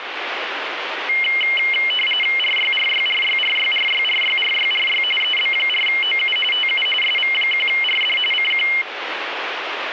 RTTY (45.45 baud, 850 Hz shift), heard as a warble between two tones, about 2550 Hz centre, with radio static. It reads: RYRYRYRYRYRYRYRY EB4OU TU SV1RD CQ